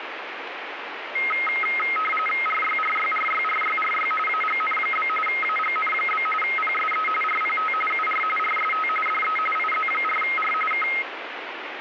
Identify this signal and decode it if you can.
RTTY (45.45 baud, 850 Hz shift), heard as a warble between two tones, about 1700 Hz centre, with radio static. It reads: RYRYRYRYRY AGN? AGN? PSE RPT UR RST DE IZ4R K